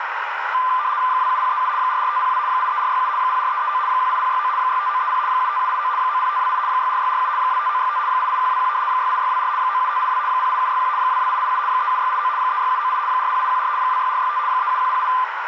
RTTY (75 baud, 170 Hz shift), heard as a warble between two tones, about 1100 Hz centre, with radio static and a narrow filter. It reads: 27037 44502 83467 04339 18069 65930 75789 90528 64647 25965 88121 68624 97582 08761 22887 37689 36798 40814 26465 37108